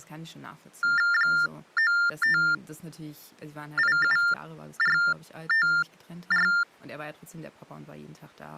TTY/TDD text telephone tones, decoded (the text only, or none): 9587454